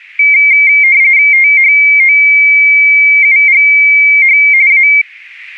RTTY (45.45 baud, 170 Hz shift), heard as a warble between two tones, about 2200 Hz centre. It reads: THOUGH A